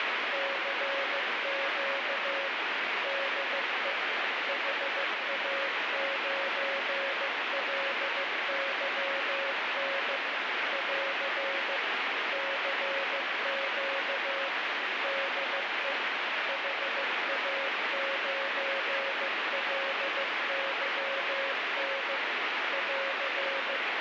Morse code, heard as a keyed tone, machine-sent, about 15 wpm, 550 Hz, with heavy radio static. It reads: CQ DE HA9LYN <AR> CQ DE HA9LYN <AR>